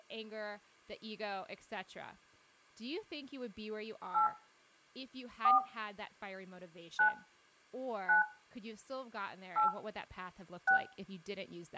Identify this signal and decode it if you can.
DTMF, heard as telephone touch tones, dialled by hand, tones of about 120 ms, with speech in English. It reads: 8 4 9 9 8 6